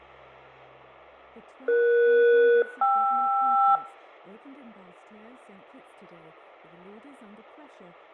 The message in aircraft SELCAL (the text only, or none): ES-KR